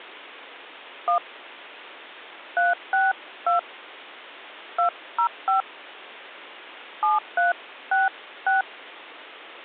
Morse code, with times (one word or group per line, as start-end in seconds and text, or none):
none